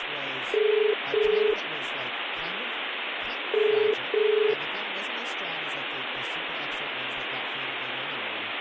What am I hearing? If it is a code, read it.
Telephone call progress tone (as in the UK, Ireland, Australia and similar networks), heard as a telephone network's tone, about 430 Hz, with phone line noise and speech in English. Ringback tone.